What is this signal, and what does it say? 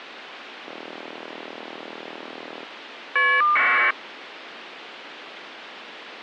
Caller ID data burst, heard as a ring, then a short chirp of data, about 1200 baud, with phone line noise.